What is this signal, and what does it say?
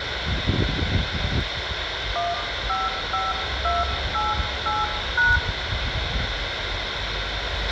DTMF, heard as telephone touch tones, dialled by hand, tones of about 190 ms, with radio hiss, a squelch burst at the end, room echo and the noise of a residential street. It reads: 155288#